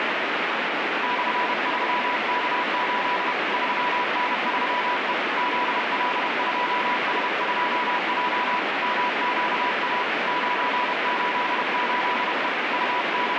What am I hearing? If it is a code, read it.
Morse code, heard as a keyed tone, hand-sent with a paddle, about 31 wpm, 980 Hz, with heavy radio static. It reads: /3K8 3N3E ZL2S2J MQA 988E …